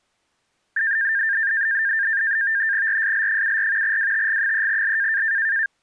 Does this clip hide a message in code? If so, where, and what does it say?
Yes: NAVTEX (SITOR-B), 100 baud, 170 Hz shift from 0.8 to 5.7 s, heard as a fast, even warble, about 1700 Hz centre. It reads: RSL74 WTG3L